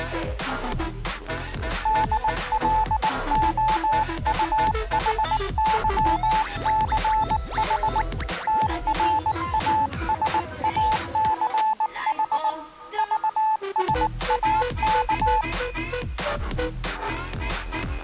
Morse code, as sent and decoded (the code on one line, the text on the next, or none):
-.. .-.. --- ..- .... -.-- -.-. .... / - .-. .- ... .- -.-. .... / ...- ... .- -.-
DLOUHYCH TRASACH VSAK